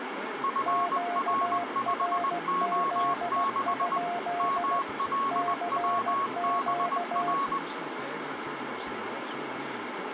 Morse code, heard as two keyed tones, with radio static. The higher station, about 20 wpm, 1100 Hz: FR5O6 MLWBR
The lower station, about 16 wpm, 700 Hz: QRZ? CQ